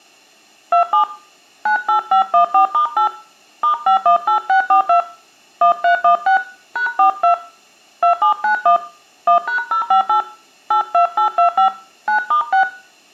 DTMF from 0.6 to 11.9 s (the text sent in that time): 27 98514*8 *518642 1316 #42 2791 1#058 82825